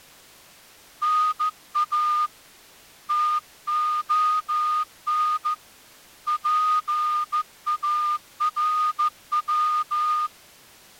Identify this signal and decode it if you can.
Morse code (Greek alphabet), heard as a whistle, hand-sent with a straight key, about 14 wpm. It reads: ΝΑ ΤΟΝ ΠΑΡΩ